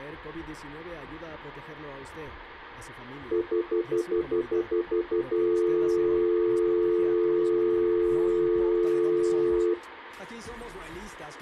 Telephone call progress tone (North American plan), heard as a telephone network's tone, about 350, 440 Hz, 0.1 s on and 0.1 s off. Stutter dial tone.